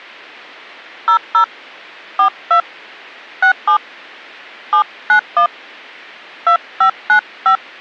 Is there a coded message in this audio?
Yes: DTMF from 1.1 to 7.6 s, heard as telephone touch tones, dialled by hand, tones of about 100 ms. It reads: 00 42 67 791 2595